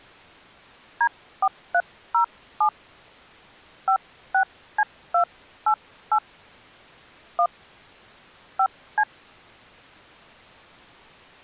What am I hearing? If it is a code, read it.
DTMF, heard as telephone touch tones, dialled by hand, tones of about 80 ms. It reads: D4307 56C288 1 5C